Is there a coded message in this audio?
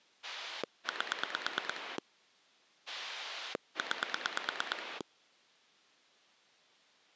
Yes: pulse dialling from 0.2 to 5.0 s, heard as a rotary dial, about 9 pulses a second. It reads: 8 9